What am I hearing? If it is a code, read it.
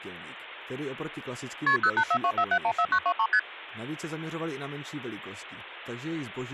Multi-frequency trunk signalling (R1, as on North American trunks), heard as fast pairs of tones, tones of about 70 ms, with speech in Czech. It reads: KP 08424714923 ST